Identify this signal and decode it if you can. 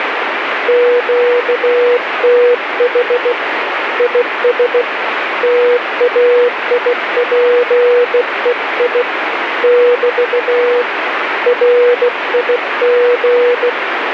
Morse code, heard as a keyed tone, hand-sent with a bug key, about 16 wpm, 490 Hz, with radio static. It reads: QTH IS TAIPEI <BT> RIG